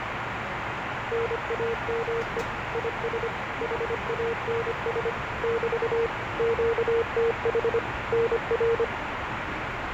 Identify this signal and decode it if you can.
Morse code, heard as a keyed tone, machine-sent, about 25 wpm, 460 Hz, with radio static and the noise inside a subway train. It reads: NAME IS HANS <BT> QTH NR